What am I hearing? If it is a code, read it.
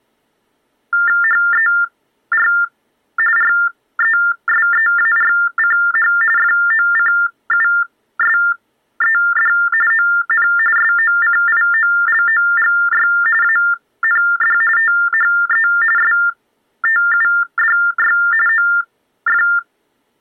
TTY/TDD text telephone tones (45.45 baud Baudot), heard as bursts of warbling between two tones, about 400 Hz shift, 1600 Hz centre. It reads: HER RESEARCH FOCUSED ON SOCIOLOGY AND THE STUDY OF